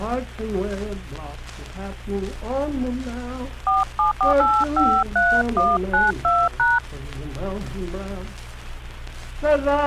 DTMF, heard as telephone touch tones, dialled by hand, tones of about 210 ms. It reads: 474853192#